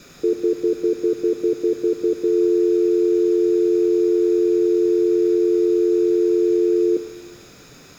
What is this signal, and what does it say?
Telephone call progress tone (North American plan), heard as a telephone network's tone, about 350, 440 Hz, 0.1 s on and 0.1 s off, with room echo. Stutter dial tone.